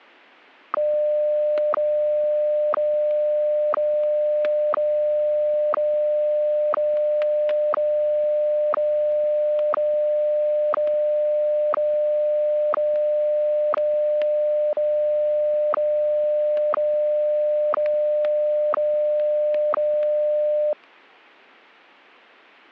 Radio time signal (WWVH, Hawaii), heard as ticks, one a second, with static crashes.